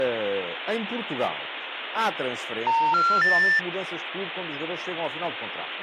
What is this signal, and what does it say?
Telephone call progress tone (North American plan), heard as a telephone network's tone, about 910, 1370, 1800 Hz, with phone line noise and speech in Portuguese. Special information tone.